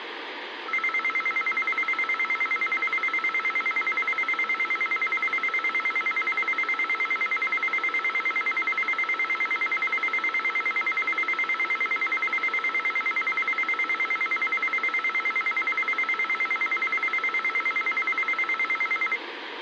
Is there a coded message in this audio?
No, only a tone that alternates evenly between two pitches, with radio hiss and a squelch burst at the end.